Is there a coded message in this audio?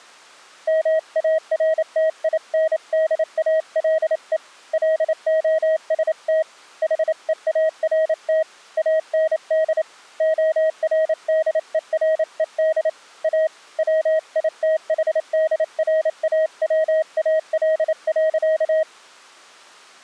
Yes: Morse code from 0.6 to 18.9 s, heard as a keyed tone, hand-sent with a paddle, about 28 wpm, 630 Hz. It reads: MARTINDALE LOST HEART AND ORDERED A WITHDRAWAL.